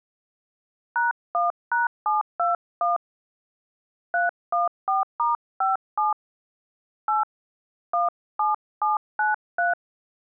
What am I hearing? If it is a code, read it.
DTMF, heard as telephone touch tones, dialled by hand, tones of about 150 ms. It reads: #1#721 314*57 8 17793